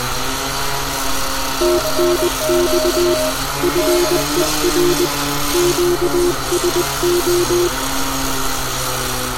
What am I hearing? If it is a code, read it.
Morse code, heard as two keyed tones, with radio static, room echo and street noise. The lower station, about 20 wpm, 350 Hz: TNX FER QSO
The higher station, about 21 wpm, 620 Hz: CQ DE